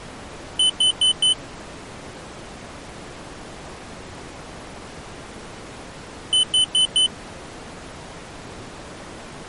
Alarm pattern, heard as an alarm's beeps, played twice, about 3000 Hz. Temporal four. Carbon monoxide.